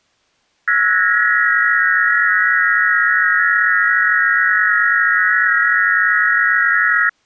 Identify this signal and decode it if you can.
FT8 (several signals at once), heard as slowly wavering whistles, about 6.25 baud.